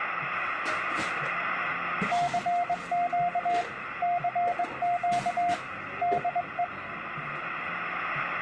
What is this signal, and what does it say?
Morse code, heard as a keyed tone, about 21 wpm, 700 Hz, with radio static and the noise of a cafe. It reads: CQ CQ DE